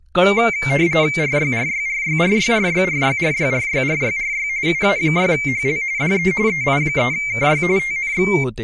RTTY (45.45 baud, 170 Hz shift), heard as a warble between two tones, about 2200 Hz centre, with speech in Marathi. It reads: RYRYRYRYRYRYRYRYRYRY UA6HL DE EI3KY TNX